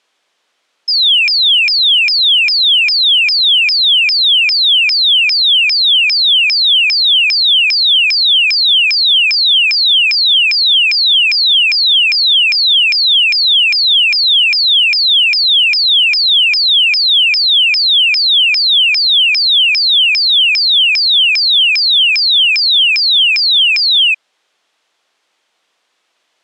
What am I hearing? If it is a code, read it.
A tone that sweeps in pitch again and again. There is no code.